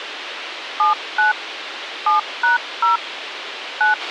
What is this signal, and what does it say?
DTMF, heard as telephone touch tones, dialled by hand, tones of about 140 ms, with radio hiss and a squelch burst at the end. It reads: 79 7#0 9